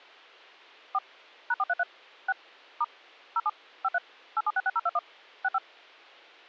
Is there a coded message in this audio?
Yes: DTMF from 0.9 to 5.6 s, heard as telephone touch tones, dialled by machine, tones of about 40 ms. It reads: 4 #433 6 * 07 53 8766021 65